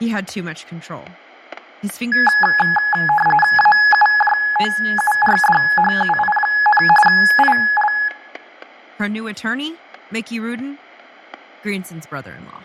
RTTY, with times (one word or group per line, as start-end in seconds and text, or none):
3.6-6.8 AUJOURDHUI,
7.1-7.9 IL